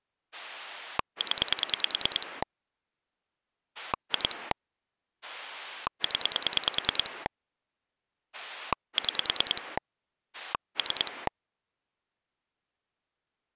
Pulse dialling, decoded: 0 2 0 6 3

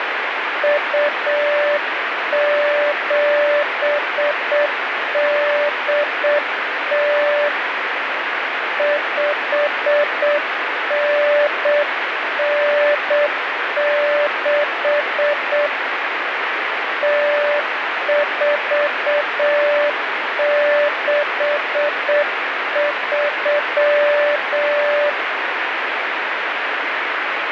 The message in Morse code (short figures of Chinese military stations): 2780 5996 0463

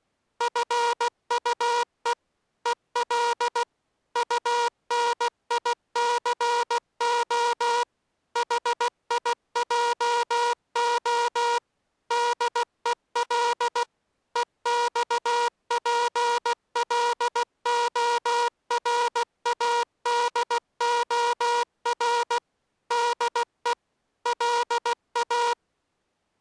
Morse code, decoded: FUE EL UNICO HIJO DEL EXPLORADOR DE LA

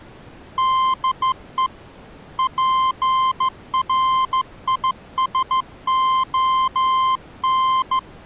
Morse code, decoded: DE PRISON

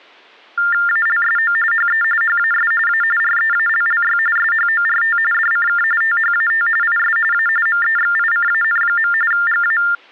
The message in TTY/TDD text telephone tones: ALSO HE HAS A REALLY SHORT DCK THAT IS A MEXICAN. GA

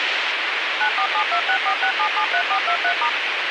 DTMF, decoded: 9472646773423*

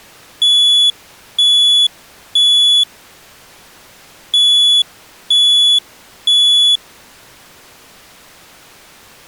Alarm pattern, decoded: temporal three

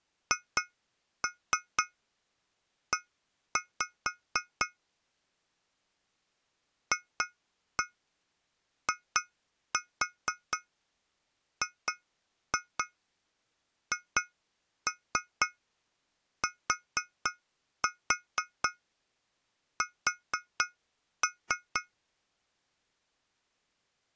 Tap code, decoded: HE FIGHTS

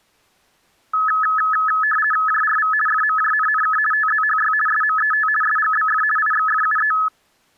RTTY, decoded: JRV FMJNNK TZHY SMET SGBF IXFUE

